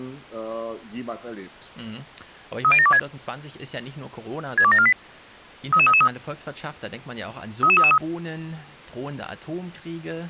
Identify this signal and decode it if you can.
Five-tone selective call (ZVEI), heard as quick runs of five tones, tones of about 70 ms. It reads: 30726 62748 33333 33333